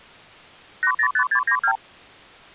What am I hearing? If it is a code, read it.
Multi-frequency trunk signalling (R2, with the far end's replies), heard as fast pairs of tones, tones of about 80 ms. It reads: 805692